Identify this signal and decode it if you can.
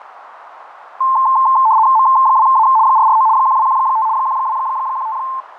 RTTY (75 baud, 170 Hz shift), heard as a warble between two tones, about 970 Hz centre, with radio static, fading and a narrow filter. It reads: M2A 449 1215 1215